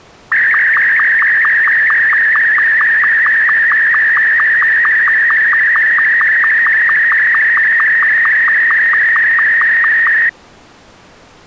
SSTV (slow-scan television), Martin M2, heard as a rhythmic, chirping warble.